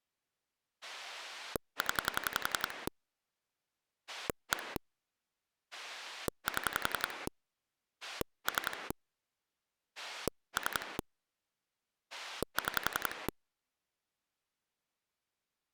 Pulse dialling, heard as a rotary dial, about 11 pulses a second. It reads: 0 1 7 3 3 6